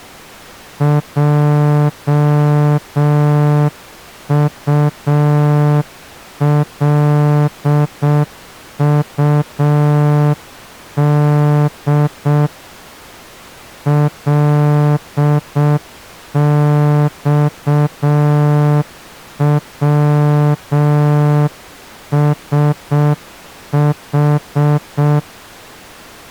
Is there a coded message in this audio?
Yes: Morse code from 0.7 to 25.3 s, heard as a horn, hand-sent with a straight key, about 6 wpm. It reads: JULUD LXWSH